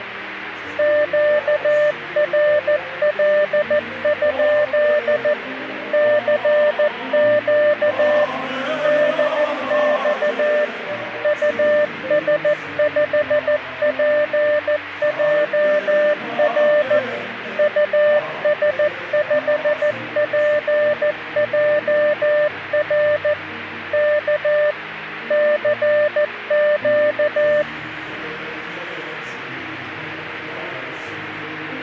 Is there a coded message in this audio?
Yes: Morse code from 0.7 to 27.7 s, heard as a keyed tone, machine-sent, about 14 wpm, 600 Hz, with radio static. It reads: QRL? CQ DX US5PJR US5PJR K CQ